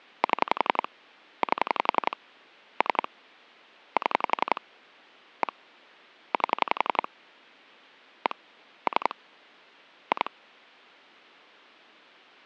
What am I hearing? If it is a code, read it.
Pulse dialling, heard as clicks on a phone line, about 11 pulses a second. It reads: 7 8 3 7 1 8 1 3 2